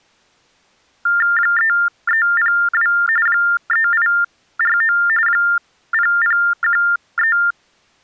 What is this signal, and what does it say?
TTY/TDD text telephone tones (45.45 baud Baudot), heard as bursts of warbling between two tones, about 400 Hz shift, 1600 Hz centre. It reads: 3302 3849 0013